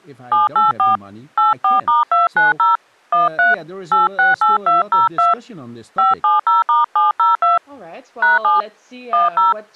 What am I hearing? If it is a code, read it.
DTMF, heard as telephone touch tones, dialled by hand, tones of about 160 ms, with speech in English. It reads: 784 84*290 13 868202 570*702 #7 10